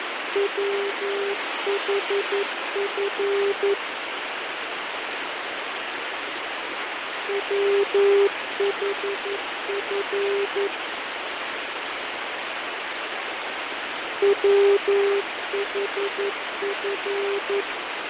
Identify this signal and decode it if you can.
Morse code, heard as a keyed tone, machine-sent, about 11 wpm, 400 Hz, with heavy radio static and fading. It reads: WHF WHF WHF